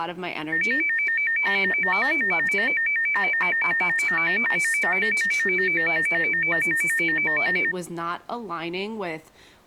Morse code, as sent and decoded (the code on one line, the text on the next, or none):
none